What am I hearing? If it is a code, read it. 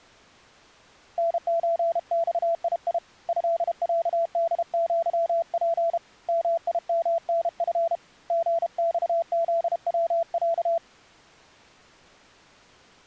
Morse code (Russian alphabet), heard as a keyed tone, hand-sent with a paddle, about 32 wpm, 670 Hz. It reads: НЧЬИИ ЭЯДЪП МИМНФ ГЬЗВЯ